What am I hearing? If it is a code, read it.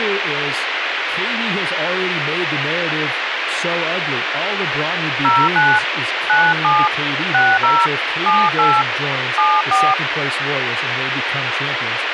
DTMF, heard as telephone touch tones, dialled by hand, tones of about 230 ms, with radio hiss and speech in English. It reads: 09 97 60 78 74